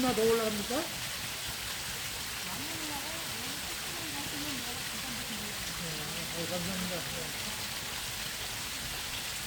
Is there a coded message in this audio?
No, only the noise of a park.